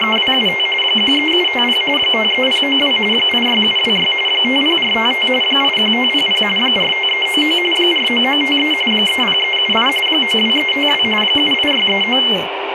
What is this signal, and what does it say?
RTTY (45.45 baud, 850 Hz shift), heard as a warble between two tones, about 2550 Hz centre, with radio static and speech in Santali. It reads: … 13750 53092 86726 50455 81500 45399 49953 30378 92352 78639